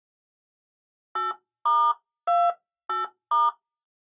DTMF, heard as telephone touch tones, dialled by hand, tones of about 190 ms. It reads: 8*28*